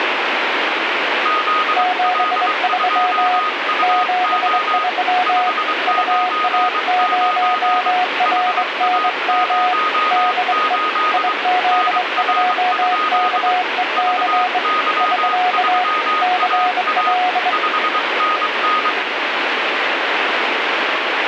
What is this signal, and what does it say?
Morse code, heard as two keyed tones, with radio static. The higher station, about 23 wpm, 1240 Hz: ZL2UO 599 HA08 NR? VY3AA 5NN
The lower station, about 23 wpm, 730 Hz: 73 73 UA0RNM DE IZ2KEC <SK> CL